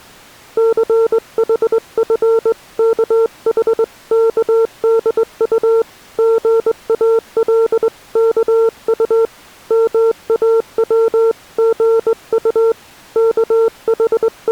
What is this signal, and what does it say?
Morse code (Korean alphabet), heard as a keyed tone, hand-sent with a straight key, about 20 wpm, 450 Hz. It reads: 춘우의 속이 몹시 …